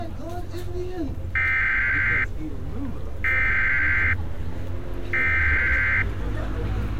Emergency Alert System (SAME) tones (header bursts), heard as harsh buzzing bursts, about 520.83 baud, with street noise.